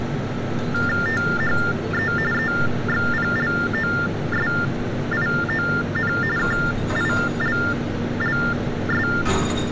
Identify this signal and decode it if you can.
TTY/TDD text telephone tones (45.45 baud Baudot), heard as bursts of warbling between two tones, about 400 Hz shift, 1600 Hz centre, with street noise. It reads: THE EXPLOSION KILLS